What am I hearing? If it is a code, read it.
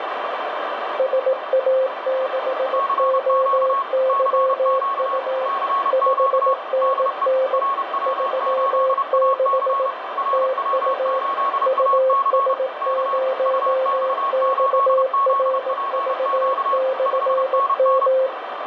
Morse code, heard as two keyed tones, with heavy radio static. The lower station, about 18 wpm, 520 Hz: SA6OYU 5NN 36 TU US0XRV/M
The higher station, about 30 wpm, 1100 Hz: CQ CQ CQ DE RW8AC RW8AC K UX8ZPQ 5NN